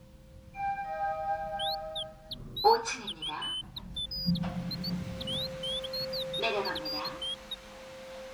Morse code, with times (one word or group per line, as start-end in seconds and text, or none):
none